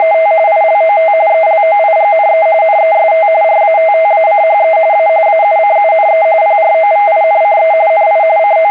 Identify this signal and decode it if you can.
RTTY (45.45 baud, 170 Hz shift), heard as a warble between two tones, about 730 Hz centre, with a steady whistle near 2090 Hz. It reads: … ILOT ELOIGNE NEST RATTACHE A AUCUNE PROVINCE NI …